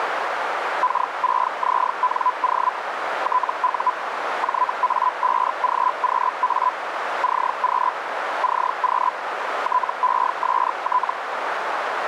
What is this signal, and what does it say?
Hellschreiber (Feld-Hell, 122.5 baud), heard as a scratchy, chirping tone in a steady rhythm, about 1000 Hz, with radio static and a narrow filter. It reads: K6ZNO TU JA5GQA CQ CQ TEST